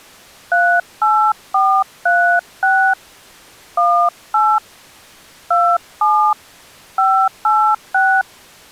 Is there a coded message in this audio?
Yes: DTMF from 0.5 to 8.2 s, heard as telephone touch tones, dialled by hand, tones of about 300 ms. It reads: 38436 18 27 586